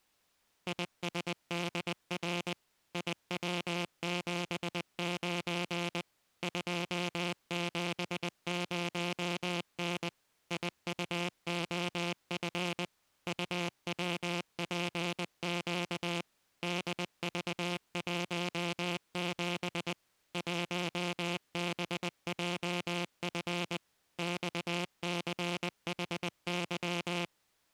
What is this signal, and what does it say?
Morse code, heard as a buzzer, machine-sent, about 20 wpm. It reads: ISDR IW79 270N IUOF UWPQ DV17 1BJF XCHY